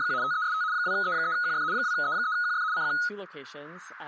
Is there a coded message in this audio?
Yes: RTTY (75 baud, 170 Hz shift) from 0.0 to 3.1 s, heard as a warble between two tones, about 1360 Hz centre, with speech in English. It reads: … TEST 2E3QF 2E3QF CQ